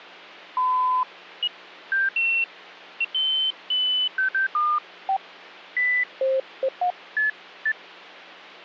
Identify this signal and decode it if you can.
Electronic bleeps of random pitch and length, with phone line noise. There is no code.